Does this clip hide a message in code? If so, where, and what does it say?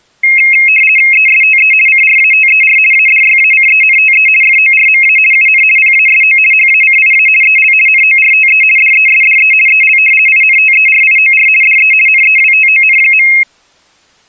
Yes: RTTY (50 baud, 450 Hz shift) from 0.2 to 13.4 s, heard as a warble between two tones, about 2350 Hz centre. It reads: ESTE CRATER ADYACENTE FORMA UN PASO HACIA EL NORTE DESDE EL INTERIOR DE NEWTON.